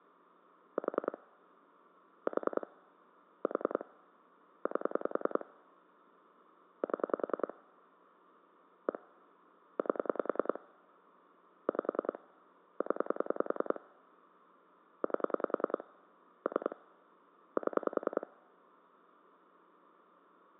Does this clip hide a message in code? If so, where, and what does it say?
Yes: pulse dialling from 0.8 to 18.2 s, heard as clicks on a phone line, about 10 pulses a second. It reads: 4 4 4 8 7 1 8 5 0 8 3 7